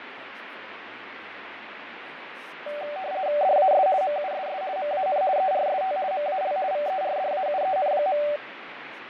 RTTY (50 baud, 170 Hz shift), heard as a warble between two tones, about 670 Hz centre, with radio static, fading and speech in English. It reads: DAS MUSS MAN ERST MAL VERDAUEN.